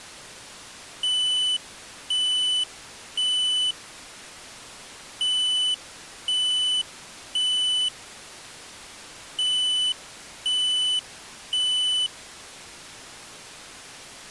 Alarm pattern, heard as an alarm's beeps, played three times, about 3000 Hz. Temporal three. Smoke or fire, evacuate.